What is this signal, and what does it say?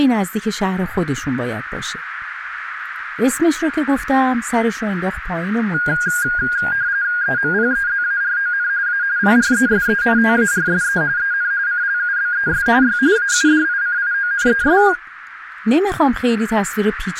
RTTY (45.45 baud, 170 Hz shift), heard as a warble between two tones, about 1550 Hz centre, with radio static and speech in Persian. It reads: EMPEZARON A PRESENTARSE EN CLUBES Y AUDICIONES